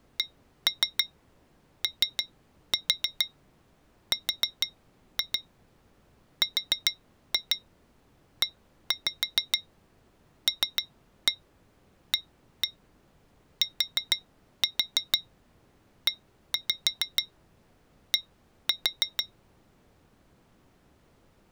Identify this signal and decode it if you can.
Tap code, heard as taps on glass, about 6 knocks a second. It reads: CORRELATED